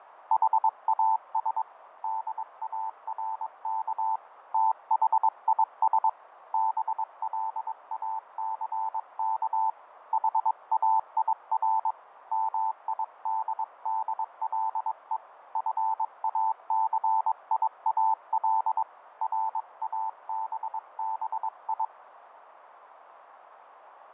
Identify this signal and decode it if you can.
Morse code, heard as a keyed tone, hand-sent with a paddle, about 22 wpm, 880 Hz, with radio static and fading. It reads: HAS DARK THIS BLACK HAIR MIDDLE FACIAL RABBI